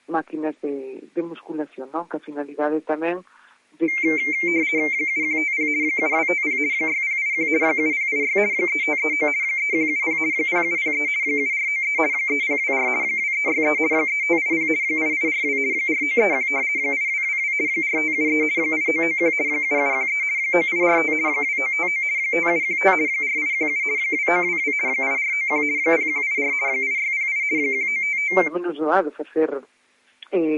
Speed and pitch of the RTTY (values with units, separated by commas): 50 baud, 170 Hz shift, 2200 Hz centre